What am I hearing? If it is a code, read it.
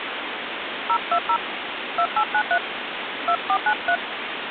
DTMF, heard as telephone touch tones, dialled by hand, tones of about 70 ms, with phone line noise. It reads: 020 2893 2493